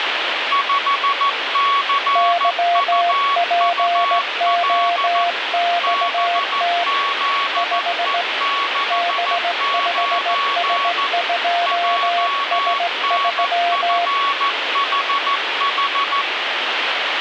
Morse code, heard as two keyed tones, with radio static. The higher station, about 14 wpm, 1120 Hz: 5CUUL BZE69 JNFHH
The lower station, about 17 wpm, 700 Hz: YPOXT 5 B5S2S3